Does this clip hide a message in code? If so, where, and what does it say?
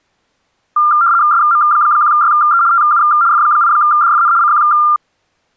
Yes: RTTY (75 baud, 170 Hz shift) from 0.8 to 5.0 s, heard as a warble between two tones, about 1290 Hz centre. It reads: SM1YE TU F8DFN CQ